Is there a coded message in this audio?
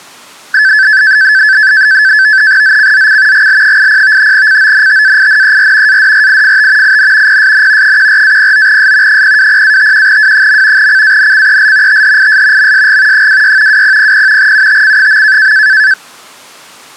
Yes: NAVTEX (SITOR-B), 100 baud, 170 Hz shift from 0.5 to 15.9 s, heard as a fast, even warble, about 1650 Hz centre. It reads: ZCZC GL80 CONTAINER ADRIFT IN PSN 14-09S 020-51W. CANCEL THIS MSG 26 2000 UTC.